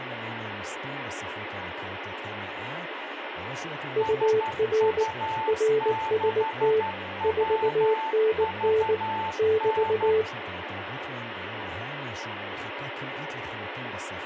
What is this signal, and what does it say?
Morse code, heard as two keyed tones, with radio static and speech in Hebrew. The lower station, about 19 wpm, 440 Hz: UR RST 4NN <BT>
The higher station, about 12 wpm, 880 Hz: SU6WVN